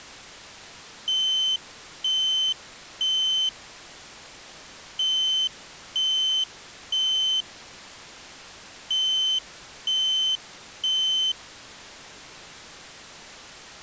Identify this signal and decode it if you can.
Alarm pattern, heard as an alarm's beeps, played three times, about 3050 Hz. Temporal three. Smoke or fire, evacuate.